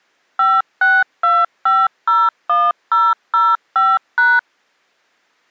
DTMF, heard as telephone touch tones, dialled by machine, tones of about 220 ms. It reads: 562501005#